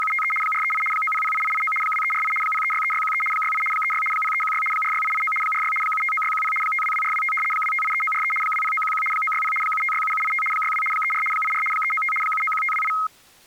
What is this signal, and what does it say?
RTTY (75 baud, 850 Hz shift), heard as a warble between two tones, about 1700 Hz centre. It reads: … 438 9008889 2348 0363613 68 36 0316 46889 46 759610 522425 2583943 20911 960 7567785 62 34 84 395 791528